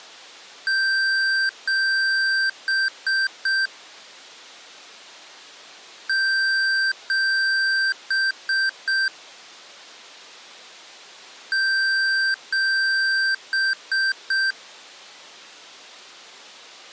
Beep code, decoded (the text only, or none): 2 long, 3 short